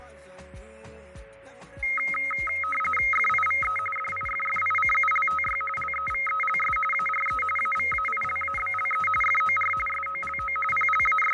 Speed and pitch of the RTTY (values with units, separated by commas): 45.45 baud, 850 Hz shift, 1700 Hz centre